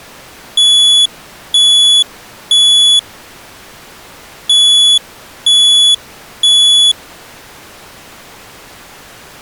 Alarm pattern, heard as an alarm's beeps, played twice, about 3400 Hz. Temporal three. Smoke or fire, evacuate.